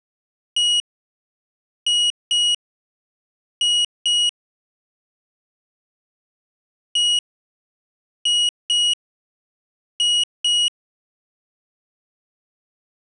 Beep code, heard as a piezo beeper, played twice, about 2900 Hz. 1-2-2. In Phoenix BIOS tables: DMA initialisation failure.